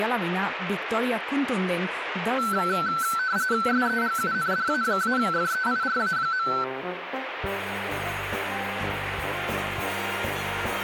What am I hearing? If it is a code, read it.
RTTY (45.45 baud, 170 Hz shift), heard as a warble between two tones, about 1430 Hz centre, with radio static. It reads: SEGUNDA-FEIRA.